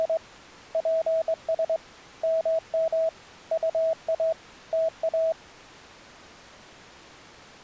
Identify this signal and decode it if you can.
Morse code, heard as a keyed tone, hand-sent with a straight key, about 22 wpm, 650 Hz. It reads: … PS MM UA TA